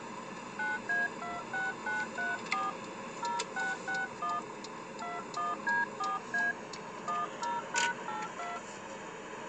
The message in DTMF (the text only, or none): 9A26934 0661 21D4A 10#82